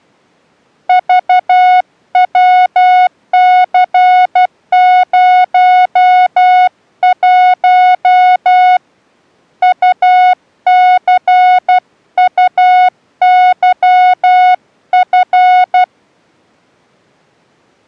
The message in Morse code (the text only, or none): VWC01 UCUYF